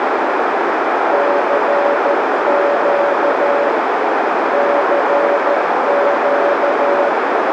Morse code, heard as a keyed tone, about 13 wpm, 570 Hz, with heavy radio static and a narrow filter. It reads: CQ CQ